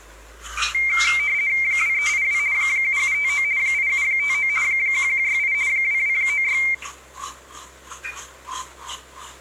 RTTY (50 baud, 170 Hz shift), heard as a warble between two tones, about 2200 Hz centre, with room echo and the noise of a restroom. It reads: 2382 7759 8759 1168 2296